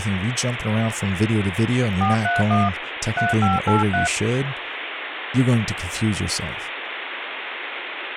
DTMF, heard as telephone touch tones, dialled by hand, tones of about 160 ms, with phone line noise and speech in English. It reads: 431 3583